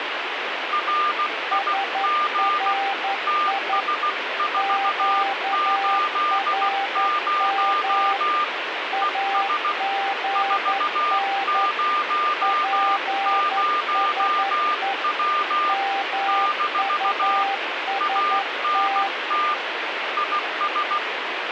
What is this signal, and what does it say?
Morse code, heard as two keyed tones, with radio static. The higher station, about 16 wpm, 1200 Hz: RIG TS480 ES 400W - ANT IS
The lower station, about 11 wpm, 790 Hz: SRI QRM AGN PSE MUST